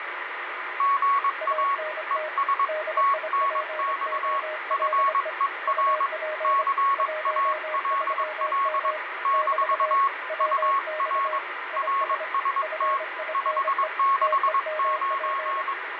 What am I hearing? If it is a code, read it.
Morse code, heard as two keyed tones, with radio static and fading. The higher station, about 22 wpm, 1100 Hz: GA ES TNX FER CALL - UR RST 569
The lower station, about 25 wpm, 620 Hz: ANT DIPOLE UP 13M <BT> WX IS FINE TEMP